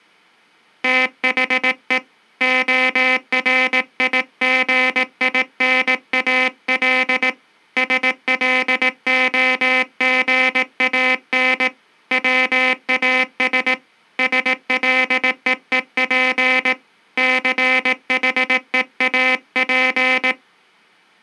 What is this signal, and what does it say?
Morse code, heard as a buzzer, hand-sent with a paddle, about 18 wpm. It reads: THE ORIGINAL SLOGAN WAS SLEEP CHEAP